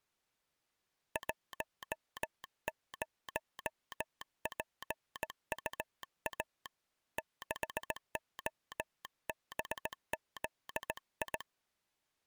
Morse code, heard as a telegraph sounder, hand-sent with a straight key, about 17 wpm. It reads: 10PUA 6OBZI